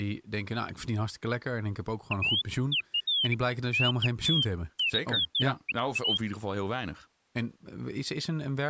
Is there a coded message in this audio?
No, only bird-like chirps, with speech in Dutch.